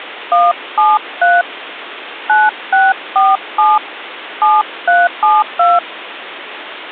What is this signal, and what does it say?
DTMF, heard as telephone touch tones, dialled by hand, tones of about 200 ms, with phone line noise. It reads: 173 9647 7372